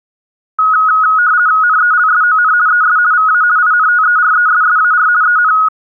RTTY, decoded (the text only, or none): NELSON ES VA INTERESSAR EN